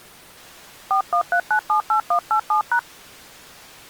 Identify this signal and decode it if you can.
DTMF, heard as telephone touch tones, dialled by hand, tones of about 90 ms. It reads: 413978187#